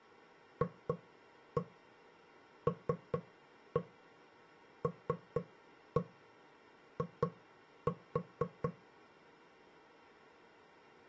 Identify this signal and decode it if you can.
Tap code, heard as knocks on wood, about 4 knocks a second. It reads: FLLI